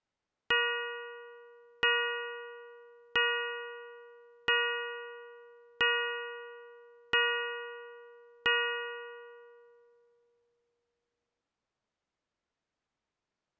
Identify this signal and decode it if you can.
Clock strike, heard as a bell. 7. Seven o'clock.